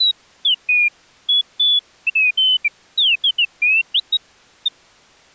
Bird-like chirps. There is no code.